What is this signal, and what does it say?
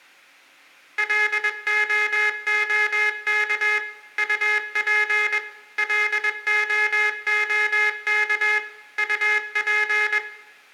Morse code, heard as a buzzer, machine-sent, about 21 wpm, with room echo. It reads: LOOK UP LOOK UP